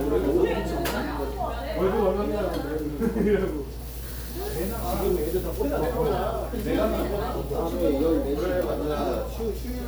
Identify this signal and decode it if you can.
The noise of a crowd indoors. There is no code.